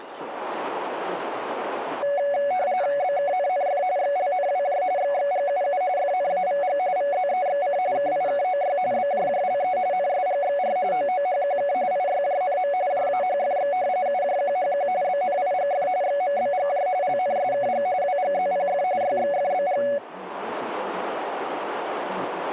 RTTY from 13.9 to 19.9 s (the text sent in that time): UJQHQ BNIGF XMBGJ LNSKG WGZPF YXFBG